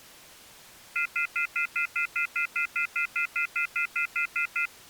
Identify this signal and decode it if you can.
Telephone call progress tone (North American plan), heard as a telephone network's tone, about 1400, 2050, 2450, 2600 Hz, 0.1 s on and 0.1 s off. Off-hook warning tone.